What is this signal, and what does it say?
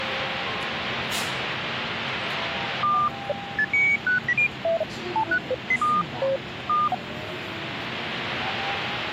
Electronic bleeps of random pitch and length, with radio static and the noise inside a subway train. There is no code.